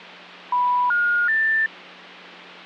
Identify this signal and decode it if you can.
Telephone call progress tone (North American plan), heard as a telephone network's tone, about 980, 1430, 1800 Hz, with hum. Special information tone.